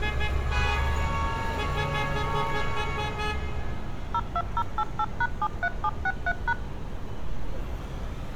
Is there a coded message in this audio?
Yes: DTMF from 4.1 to 6.5 s, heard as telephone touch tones, dialled by machine, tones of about 50 ms, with street noise. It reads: 02088#73763#